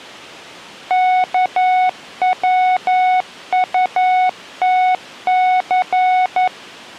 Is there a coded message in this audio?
Yes: Morse code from 0.8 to 6.5 s, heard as a keyed tone, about 11 wpm, 740 Hz. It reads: KWUTC